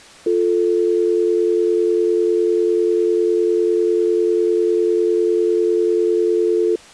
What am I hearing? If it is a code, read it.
Telephone call progress tone (North American or UK plan), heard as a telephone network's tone, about 350, 440 Hz. Dial tone.